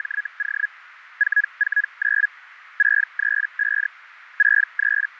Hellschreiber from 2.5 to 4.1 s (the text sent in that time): 635